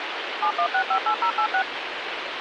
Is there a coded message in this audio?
Yes: DTMF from 0.4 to 1.6 s, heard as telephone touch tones, dialled by machine, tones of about 80 ms, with phone line noise. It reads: 71658086